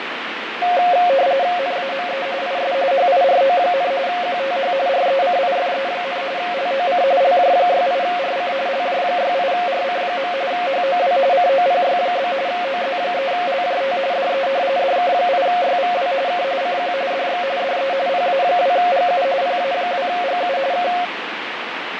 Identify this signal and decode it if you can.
RTTY (45.45 baud, 170 Hz shift), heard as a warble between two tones, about 630 Hz centre, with radio static and fading. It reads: NAME IS HIRO, QTH RECIFE, LOC LJ68RC LJ68RC. HOW COPY? OZ3LJT DE DK8YVW K CQ DX DE PA2GU PA2GU K